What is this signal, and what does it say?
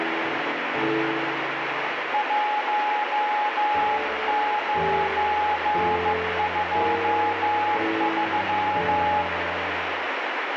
Morse code, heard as a keyed tone, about 15 wpm, 840 Hz, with heavy radio static. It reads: 1923